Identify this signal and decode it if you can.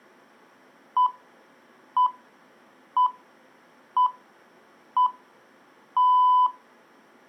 Radio time signal (six pips, as the Greenwich Time Signal), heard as pips.